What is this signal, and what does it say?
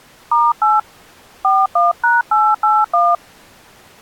DTMF, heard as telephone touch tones, dialled by hand, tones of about 210 ms. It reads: *8 41#881